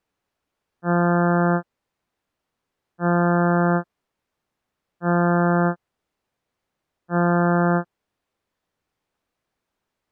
Ship horn signal, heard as a ship's horn, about 170 Hz. 4 short. At sea: a pilot vessel's identity signal in fog.